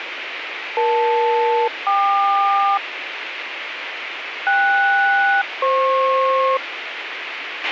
Aircraft SELCAL, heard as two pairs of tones, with radio hiss and a squelch burst at the end. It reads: EL-KQ KS-FP